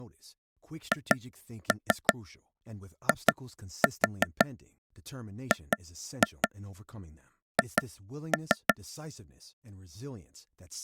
Tap code, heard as taps on a table, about 5 knocks a second, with speech in English. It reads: HIGH